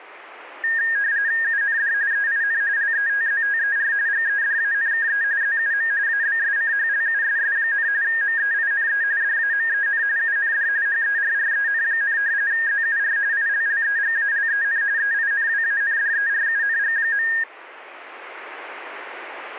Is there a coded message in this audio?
Yes: RTTY (45.45 baud, 170 Hz shift) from 0.6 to 17.4 s, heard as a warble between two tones, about 1750 Hz centre. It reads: UND EIN LETZTER GEDANKE ZUM ABSCHLUSS, MEINE DAMEN UND HERREN, ZUR ILLEGALEN EINWANDERUNG.